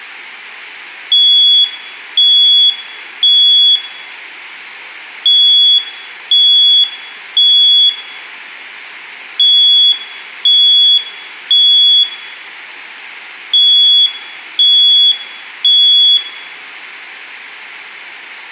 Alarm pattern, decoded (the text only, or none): temporal three